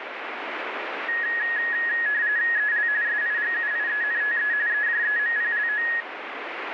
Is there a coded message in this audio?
Yes: RTTY (45.45 baud, 170 Hz shift) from 1.1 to 6.0 s, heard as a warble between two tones, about 1800 Hz centre, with radio static. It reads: EL SIGUIENTE EJEMPLO